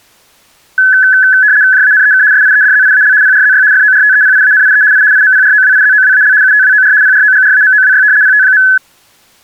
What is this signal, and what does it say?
RTTY (75 baud, 170 Hz shift), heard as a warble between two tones, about 1600 Hz centre. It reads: JANEK SIEDZIAL PRZY FORTEPIANIE I IMPROWIZOWAL UTWOR PROGRAMOWY PT.